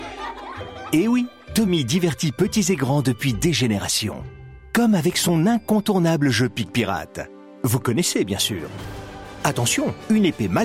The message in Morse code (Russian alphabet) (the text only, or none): none